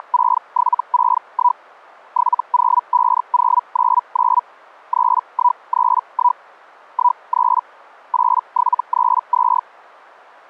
Hellschreiber (Feld-Hell, 122.5 baud), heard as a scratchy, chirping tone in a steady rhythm, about 980 Hz. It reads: … 705099 3131 13 8732